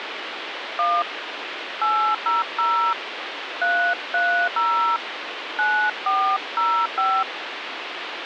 DTMF, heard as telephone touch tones, dialled by hand, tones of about 280 ms, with phone line noise. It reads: 1 800 330 9405